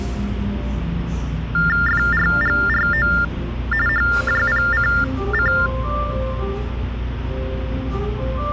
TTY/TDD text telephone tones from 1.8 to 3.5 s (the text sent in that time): FRGRO